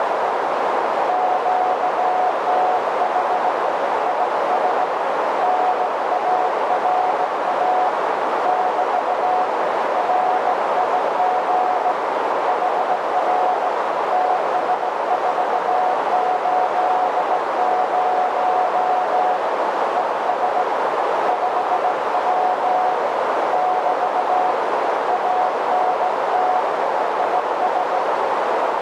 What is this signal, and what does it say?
Morse code, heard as a keyed tone, hand-sent with a straight key, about 17 wpm, 730 Hz, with heavy radio static and a narrow filter. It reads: QTH IS NARA <BT> RIG HR TS480 ES 5W <BT> ANT IS